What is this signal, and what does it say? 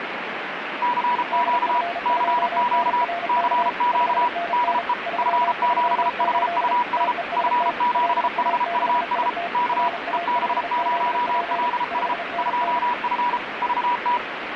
Morse code, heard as two keyed tones, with radio static. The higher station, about 33 wpm, 970 Hz: CQ CQ CQ DE F7HUS F7HUS K EB0LS 2F VT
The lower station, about 34 wpm, 690 Hz: DF2NRK 5NN 338 TEST LA6IT RA5ZP 5NN